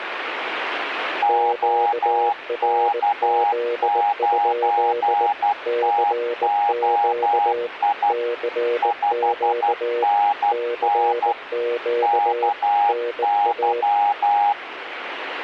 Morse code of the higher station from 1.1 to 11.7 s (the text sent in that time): OK9TOI 5NN